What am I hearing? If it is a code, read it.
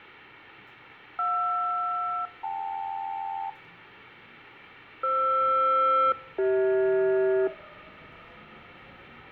Aircraft SELCAL, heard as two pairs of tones, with radio static, fading and the noise inside a subway train. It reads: JR-KL FR-CH